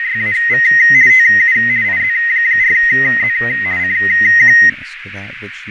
RTTY (50 baud, 170 Hz shift), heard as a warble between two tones, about 1950 Hz centre, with radio static, fading, a narrow filter and speech in English. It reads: … TU IZ4Z CQ